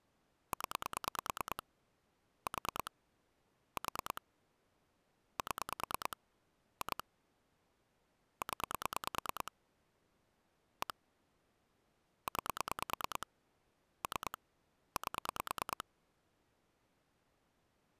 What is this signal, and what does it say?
Pulse dialling, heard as clicks on a phone line, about 9 pulses a second. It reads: 0 4 4 7 2 0 1 9 3 8